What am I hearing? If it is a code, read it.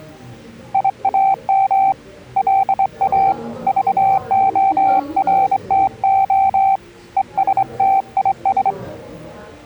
Morse code, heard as a keyed tone, hand-sent with a straight key, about 24 wpm, 780 Hz, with the noise of a crowd indoors. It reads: IAM LA VORTO ESTIS